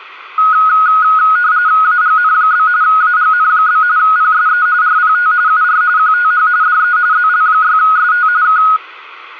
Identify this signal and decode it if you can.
RTTY (45.45 baud, 170 Hz shift), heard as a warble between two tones, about 1360 Hz centre. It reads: AGN? AGN? PSE RPT UR QTH DE ZL6ST K